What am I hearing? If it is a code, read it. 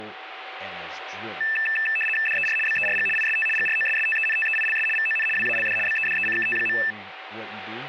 RTTY (75 baud, 850 Hz shift), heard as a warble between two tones, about 2200 Hz centre, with radio static and speech in English. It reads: DER BERG IST GROSSTENTEILS VON WALD BEDECKT.